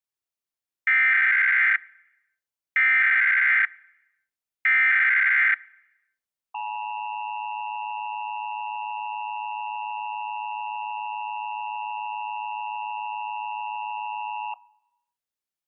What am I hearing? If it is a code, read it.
Emergency Alert System (SAME) tones (header bursts, then the 853 and 960 Hz attention tone), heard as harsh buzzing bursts, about 520.83 baud.